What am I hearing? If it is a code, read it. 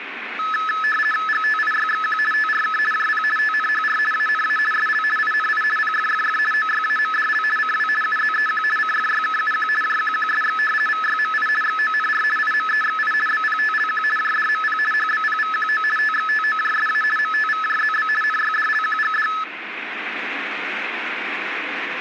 RTTY (50 baud, 450 Hz shift), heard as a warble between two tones, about 1500 Hz centre, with radio static. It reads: GTIYXQ TRK JP TNHR ANA SL INI PFFF OYAMDL CW UZEQ CFYKUQ JQQSX VYMI XONR IMEXI BPTLQ JDMP HBPVQO TXTOJSA MTVJZB NYDLQGD